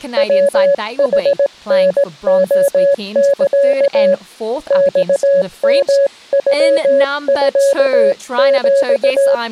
Morse code (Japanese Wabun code), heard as a keyed tone, hand-sent with a straight key, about 18 wpm, 560 Hz, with speech in English. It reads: ヤヌタレサ マヨノミヒ